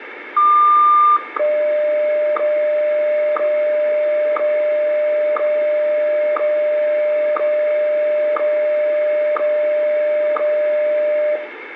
Radio time signal (WWVH, Hawaii), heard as ticks, one a second, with radio static and room echo.